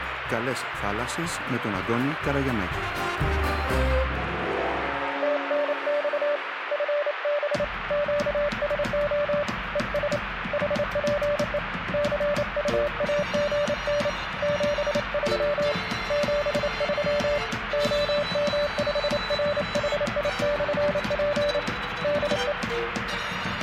Morse code, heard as a keyed tone, hand-sent with a paddle, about 28 wpm, 580 Hz, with radio static. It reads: TNX FB QSO ES HPE CUAGN 73 73 OM5RHI/P DE